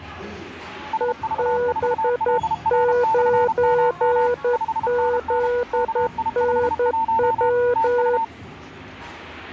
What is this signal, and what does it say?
Morse code, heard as two keyed tones, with the noise of a crowd indoors. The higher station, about 32 wpm, 900 Hz: SV4LR/MM 5NN KI51 TU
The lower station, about 11 wpm, 490 Hz: EB9ZNW